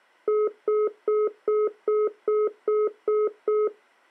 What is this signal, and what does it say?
Telephone call progress tone (single-tone plan, as in most of Europe), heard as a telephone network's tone, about 420 Hz, 0.2 s on and 0.2 s off. Congestion tone.